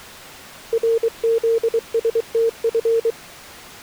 Morse code, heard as a keyed tone, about 23 wpm, 460 Hz. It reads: RZSTF